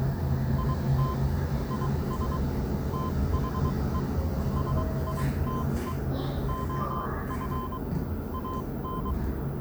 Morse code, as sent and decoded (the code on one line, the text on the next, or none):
.. - / .. ... / - .... . / ... .. - . / --- ..-. / .- -.
IT IS THE SITE OF AN